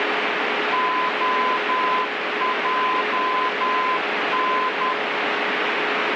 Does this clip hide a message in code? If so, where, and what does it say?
Yes: Morse code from 0.7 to 5.0 s, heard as a keyed tone, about 10 wpm, 1020 Hz, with radio static. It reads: OJN